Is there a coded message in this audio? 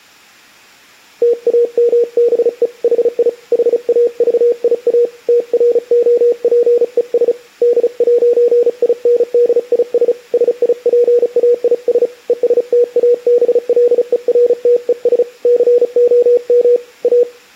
Yes: Morse code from 1.2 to 17.3 s, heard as a keyed tone, hand-sent with a paddle, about 35 wpm, 480 Hz. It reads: TAMBE HI HAVIA TROPES D'INDIS SIPAIS ESTABLERTES COM A